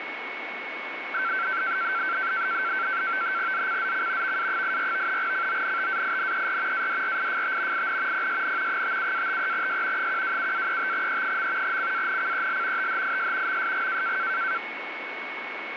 NAVTEX (SITOR-B), 100 baud, 170 Hz shift, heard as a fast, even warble, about 1450 Hz centre, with radio static and a steady whistle near 2210 Hz. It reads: ZCZC VA84 CONTAINER ADRIFT IN PSN 57-53S 127-35E. CANCEL THIS MSG